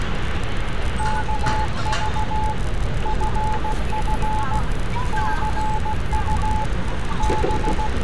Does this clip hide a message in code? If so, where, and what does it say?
Yes: Morse code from 0.9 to 8.0 s, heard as a keyed tone, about 16 wpm, 860 Hz, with radio static, room echo and street noise. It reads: KV FF CU …